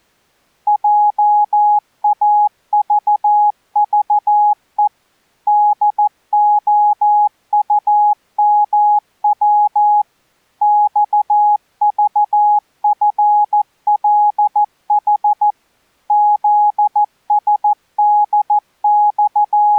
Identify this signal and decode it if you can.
Morse code, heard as a keyed tone, machine-sent, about 14 wpm, 830 Hz. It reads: JAVVE DOUMW XVFLH …